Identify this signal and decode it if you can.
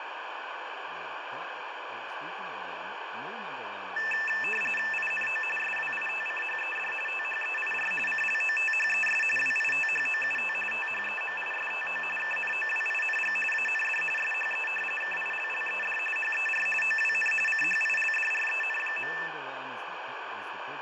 RTTY (45.45 baud, 850 Hz shift), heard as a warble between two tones, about 2200 Hz centre, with radio static, fading and speech in English. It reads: INO SWITCHED THEIR CLOTHES WITHOUT THEMISTO KNOWING AND SHE KILLED HER OWN CHILDREN.